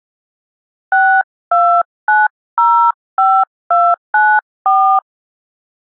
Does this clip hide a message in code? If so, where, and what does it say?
Yes: DTMF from 0.9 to 5.0 s, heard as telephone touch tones, dialled by hand, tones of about 270 ms. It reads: 62905294